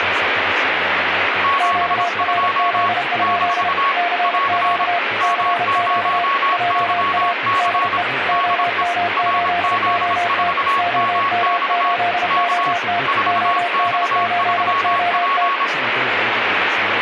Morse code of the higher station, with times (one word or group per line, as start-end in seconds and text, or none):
1.4-2.9 72
3.2-3.9 -
4.2-4.9 <AR>
5.2-8.0 M0YC
8.3-8.8 DE
9.2-11.9 RZ4MX
12.3-12.7 K
13.1-15.6 4X3P